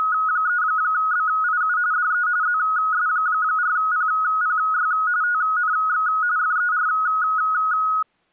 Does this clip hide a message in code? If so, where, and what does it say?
Yes: RTTY (45.45 baud, 170 Hz shift) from 0.0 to 8.0 s, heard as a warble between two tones, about 1360 Hz centre. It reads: … DE ZS4PPY TNX FER